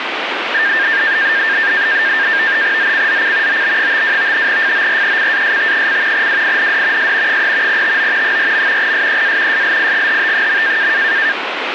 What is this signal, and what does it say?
NAVTEX (SITOR-B), 100 baud, 170 Hz shift, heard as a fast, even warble, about 1700 Hz centre, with radio static. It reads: ZCZC OB52 FORECAST: WIND S 3 TO 4. SEA SLIGHT.